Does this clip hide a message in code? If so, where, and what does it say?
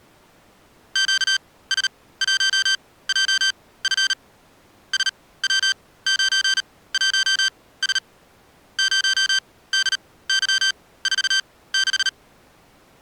Yes: Morse code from 0.9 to 12.1 s, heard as electronic beeps, machine-sent, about 38 wpm, spaced as for 19 wpm, 1550 Hz. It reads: QS1JF SW91S 0DY46